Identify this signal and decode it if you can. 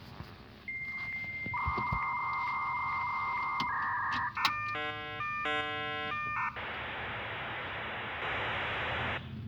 Dial-up modem handshake (V.34 or later), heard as a whistle, warbles, then hiss, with room echo and the noise inside a car.